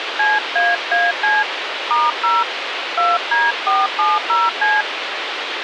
DTMF, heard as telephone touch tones, dialled by hand, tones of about 200 ms, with radio hiss. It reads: CAAC *0 2D470C